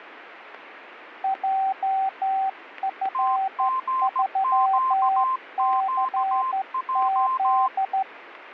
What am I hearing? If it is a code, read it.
Morse code, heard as two keyed tones, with radio static. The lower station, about 12 wpm, 770 Hz: JF3CZ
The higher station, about 17 wpm, 1040 Hz: TGQQJ